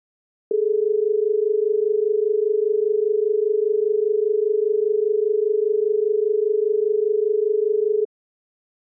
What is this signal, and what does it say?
Telephone call progress tone (as in Australia), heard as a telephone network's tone, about 430 Hz. Dial tone.